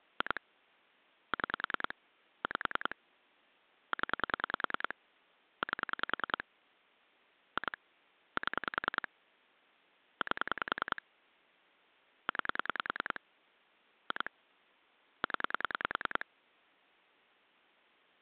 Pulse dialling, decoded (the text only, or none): 2 6 5 0 8 2 7 8 9 2 0